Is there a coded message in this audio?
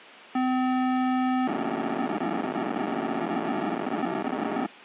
Yes: POCSAG pager data (512 baud) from 0.3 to 4.7 s, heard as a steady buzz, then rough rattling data.